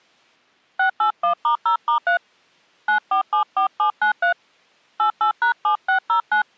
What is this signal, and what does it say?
DTMF, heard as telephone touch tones, dialled by hand, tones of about 100 ms. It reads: 681*0*3 9474793 88#7609